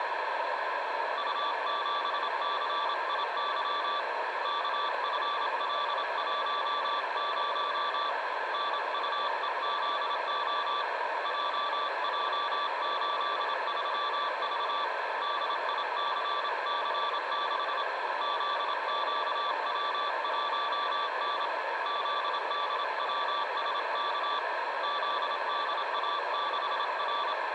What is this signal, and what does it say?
Morse code, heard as a keyed tone, hand-sent with a paddle, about 27 wpm, 1160 Hz, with radio static, a narrow filter and room echo. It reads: U7CIY KFL10 NUEZO JJ83V DICC6 ZQW1N ZDWSK ZDA6R